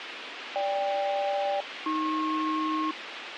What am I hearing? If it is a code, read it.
Aircraft SELCAL, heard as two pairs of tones, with radio hiss and a squelch burst at the end. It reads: GK-AP